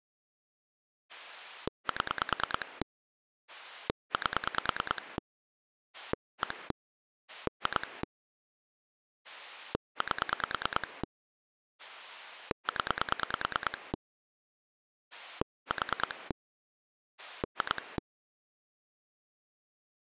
Pulse dialling, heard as a rotary dial, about 9 pulses a second. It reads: 7 8 1 2 8 0 4 2